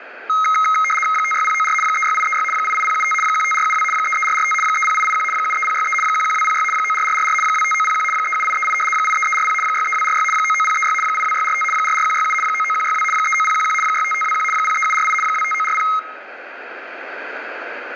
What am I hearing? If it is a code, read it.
RTTY (75 baud, 850 Hz shift), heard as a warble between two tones, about 1700 Hz centre, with radio static. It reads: 56094 36836 88075 15472 33445 30881 73063 11206 94444 25901 37838 83340 63246 99036 82645 44167 99162 39011 65521 03748 25940